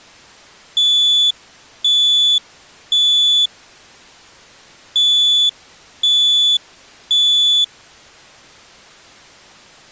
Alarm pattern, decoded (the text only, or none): temporal three